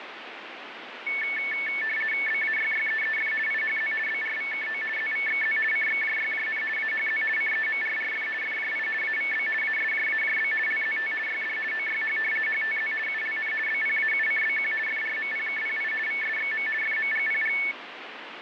RTTY (50 baud, 450 Hz shift), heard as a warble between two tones, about 2000 Hz centre, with radio static. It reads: BAYYEEF IHZ BRVKO ZVXZ CXJYJN AHZ CEMRRF FJI AVB ASJAJB LZT YD OYH HTZ ULN BPAUCBQ FRMPKPI VSXM FMGPG